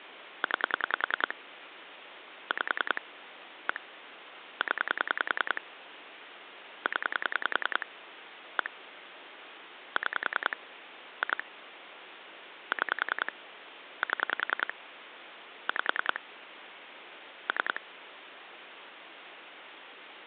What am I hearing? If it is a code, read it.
Pulse dialling, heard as clicks on a phone line, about 10 pulses a second, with phone line noise. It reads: 9 5 1 0 0 1 6 2 6 7 5 3